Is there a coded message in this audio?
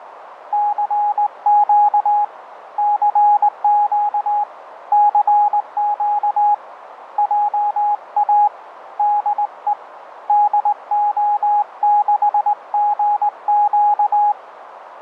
Yes: Morse code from 0.5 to 14.4 s, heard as a keyed tone, hand-sent with a straight key, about 19 wpm, 830 Hz, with radio static. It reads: CQ CQ CQ JA DE DO6GQ